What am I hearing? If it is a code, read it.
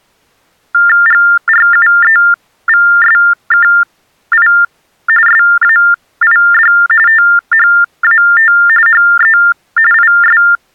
TTY/TDD text telephone tones (45.45 baud Baudot), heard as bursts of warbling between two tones, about 400 Hz shift, 1600 Hz centre. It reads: GRUEVSKI SAID THAT HE IS